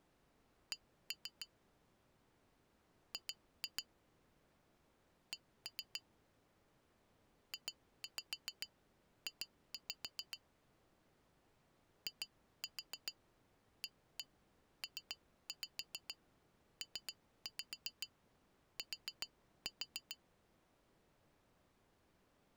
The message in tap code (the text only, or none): C G C JJ IAPPT